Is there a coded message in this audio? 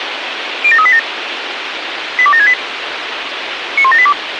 Yes: five-tone selective call (ZVEI) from 0.6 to 4.1 s, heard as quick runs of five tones, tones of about 70 ms, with radio hiss. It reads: 07387 82768 91782